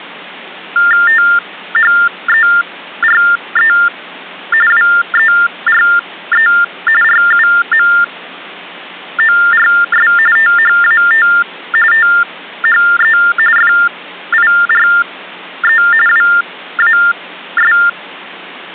TTY/TDD text telephone tones (45.45 baud Baudot), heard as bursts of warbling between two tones, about 400 Hz shift, 1600 Hz centre. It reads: THERE WERE RUMORS THAT THE FIRE WAS